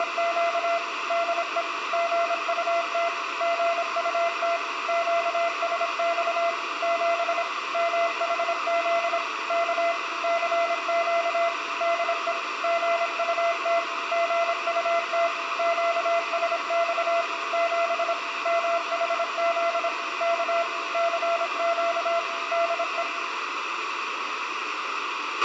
Morse code, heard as a keyed tone, machine-sent, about 26 wpm, 680 Hz, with radio hiss, a squelch burst at the end and room echo. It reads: … DE GUT GUT QSX 7 MHZ K CQ DE GUT GUT QSX 7 MHZ K CQ DE